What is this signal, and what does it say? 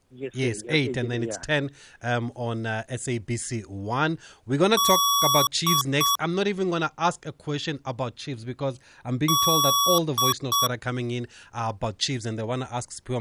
Beep code, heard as beeps from a small speaker, played twice, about 1130 Hz, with speech in English. 1 long, 2 short. In Award, IBM and AMI BIOS tables: video adapter failure.